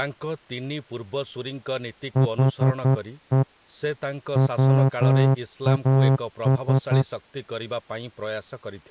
Morse code, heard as a horn, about 11 wpm, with speech in Odia. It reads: HE WAS